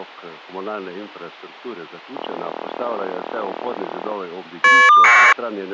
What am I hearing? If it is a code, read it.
Caller ID data burst, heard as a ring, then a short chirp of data, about 1200 baud.